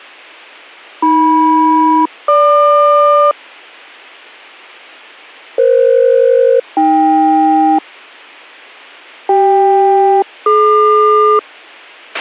Aircraft SELCAL, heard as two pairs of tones, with a squelch burst at the end. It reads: AM-GQ EF-AK CK-DQ